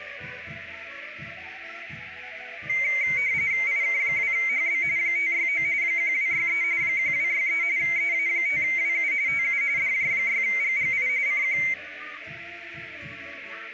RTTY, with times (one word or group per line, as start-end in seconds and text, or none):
3.7-4.8 IK2HB
5.0-5.6 569
5.8-6.6 1263
6.8-7.6 1263
7.8-9.1 EA5WU
9.3-9.6 TU
9.8-11.1 DJ6GGI
11.3-11.6 CQ